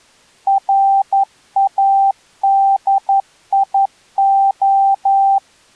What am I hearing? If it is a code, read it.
Morse code, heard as a keyed tone, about 11 wpm, 780 Hz. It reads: RADIO